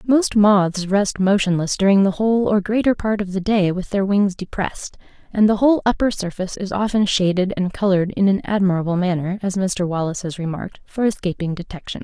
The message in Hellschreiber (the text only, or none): none